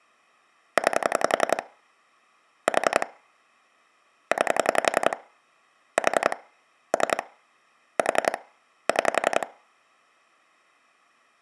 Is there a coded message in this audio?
Yes: pulse dialling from 0.8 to 9.4 s, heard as clicks on a phone line, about 11 pulses a second. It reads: 9 4 9 4 3 4 6